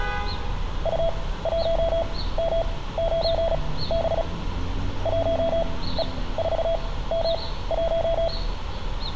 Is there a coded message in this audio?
Yes: Morse code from 0.8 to 8.3 s, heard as a keyed tone, machine-sent, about 36 wpm, spaced as for 18 wpm, 660 Hz, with room echo and street noise. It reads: U1M9B 1E4M1